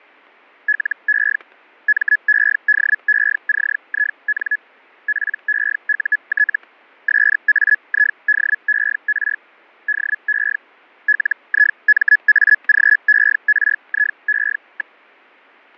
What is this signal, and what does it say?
Hellschreiber (Feld-Hell, 122.5 baud), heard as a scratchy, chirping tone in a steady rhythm, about 1700 Hz, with fading and static crashes. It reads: LE MEDECIN PEUT SAIDER DE LIMAGERIE.